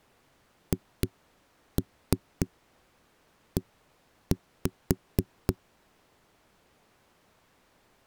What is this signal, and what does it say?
Tap code, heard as knocks on a wall, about 3 knocks a second. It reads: HE